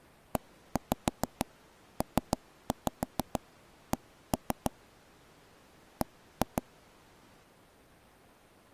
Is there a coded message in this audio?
Yes: tap code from 0.4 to 6.6 s, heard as taps on a table, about 6 knocks a second. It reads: EPC B